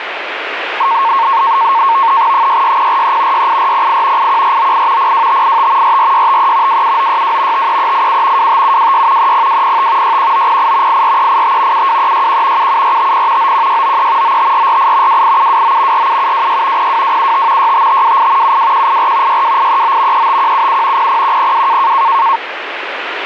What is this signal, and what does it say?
NAVTEX (SITOR-B), 100 baud, 170 Hz shift, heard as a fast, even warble, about 1000 Hz centre, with radio static. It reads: 66043 68408 81498 02585 44653 27962 53387 25726 30205 61908 84385 72361 77450 91693 95448 28729 47726 02275 65528 72184 62839 35177 00102